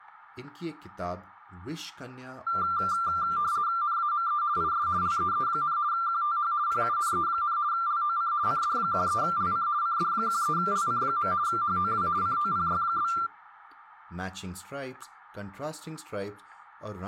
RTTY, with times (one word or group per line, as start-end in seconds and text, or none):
3.8-4.4 NAME
4.6-4.9 IS
5.0-5.8 LEE,
5.9-6.5 QTH
6.7-7.6 PUNE,
7.7-8.3 LOC
8.5-9.7 CD13LC
9.8-11.3 CD13LC.
11.5-12.1 HOW
12.2-13.1 COPY?